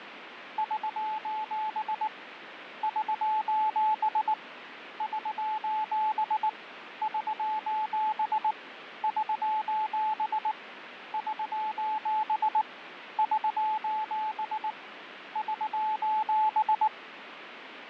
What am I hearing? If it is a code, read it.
Morse code, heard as a keyed tone, hand-sent with a bug key, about 19 wpm, 860 Hz, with radio static and fading. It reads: <SOS> <SOS> <SOS> <SOS> <SOS> <SOS> <SOS> <SOS>